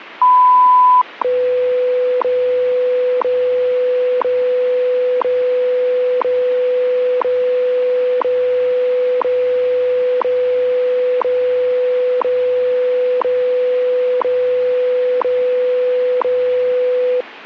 Radio time signal (WWV, Colorado), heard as ticks, one a second, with radio static.